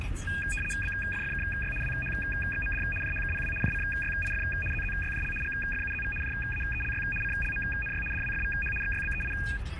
RTTY (75 baud, 850 Hz shift), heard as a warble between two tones, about 2050 Hz centre, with radio static and the noise inside a car. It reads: BFFKY WHXMD JHKPW JCYIF ZZYJL GFUZV JAELY CLMNY DWFVH XYBEI